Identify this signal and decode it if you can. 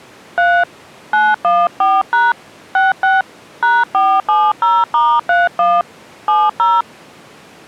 DTMF, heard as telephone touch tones, dialled by hand, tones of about 210 ms. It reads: 3 914# 66 #470*31 70